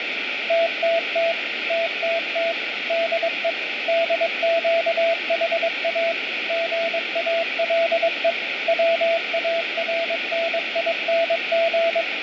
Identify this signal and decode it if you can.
Morse code, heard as a keyed tone, machine-sent, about 22 wpm, 670 Hz, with radio static. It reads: TTT TTT DE DQHA GALE WARNING